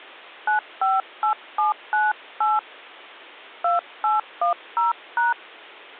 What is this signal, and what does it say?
DTMF, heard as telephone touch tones, dialled by hand, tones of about 140 ms. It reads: 958798 2810#